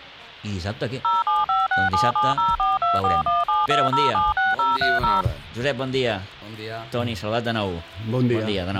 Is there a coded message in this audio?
Yes: DTMF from 1.0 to 5.2 s, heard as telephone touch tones, dialled by machine, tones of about 180 ms. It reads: 0756770424172076030